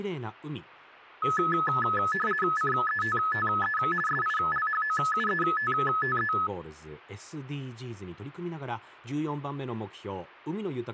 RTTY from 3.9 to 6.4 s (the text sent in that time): SILHOUETTE